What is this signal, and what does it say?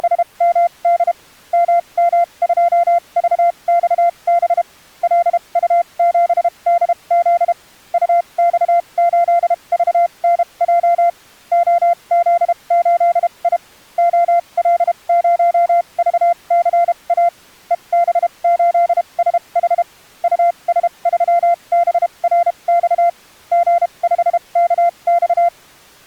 Morse code, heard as a keyed tone, machine-sent, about 32 wpm, spaced as for 26 wpm, 690 Hz. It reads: … MM2VXB LU7DZ UX8VNJ OZ8I OL0VCA EB8SH US3BRX G5KX